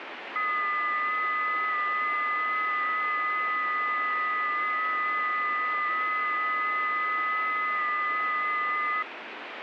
FT8 (several signals at once), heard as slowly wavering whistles, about 6.25 baud, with radio static.